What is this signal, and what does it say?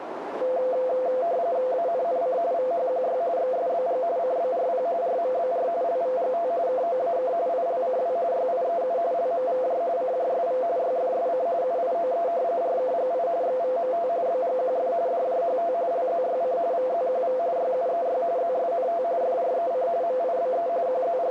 RTTY (45.45 baud, 170 Hz shift), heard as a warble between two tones, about 600 Hz centre, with radio static and a narrow filter. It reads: ANNC VHQY XSBG CBRP RMBR LVGT KOAK ILCW YIEU LMVJ CJSV YFSC UIOE RKGI XVMT BGQF DJHT LZYC VZQV YUEY ZSNT FREC MIBE …